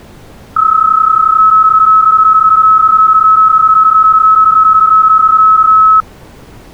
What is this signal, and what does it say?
PSK31 (31.25 baud), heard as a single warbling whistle, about 1290 Hz.